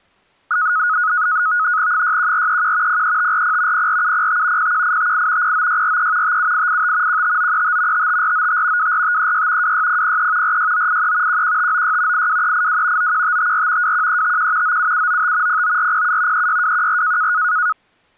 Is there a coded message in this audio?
Yes: NAVTEX (SITOR-B), 100 baud, 170 Hz shift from 0.5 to 17.7 s, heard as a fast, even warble, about 1360 Hz centre. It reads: 61431 03540 04705 01858 09643 57885 15935 55495 24536 26003 46983 11596 82382 91554 21351 97795 09407 36214